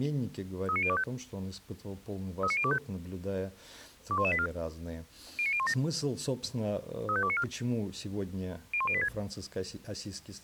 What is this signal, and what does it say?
Five-tone selective call (ZVEI), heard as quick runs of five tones, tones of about 70 ms. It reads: 39025 39025 21184 09017 35294 01086